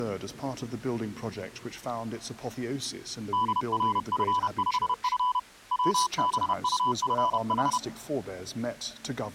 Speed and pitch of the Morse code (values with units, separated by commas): 31 wpm, 1000 Hz